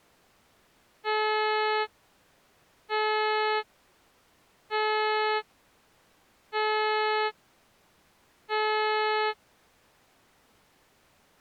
Ship horn signal, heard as a ship's horn, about 430 Hz. 5 short. At sea: I doubt that you are doing enough to avoid a collision.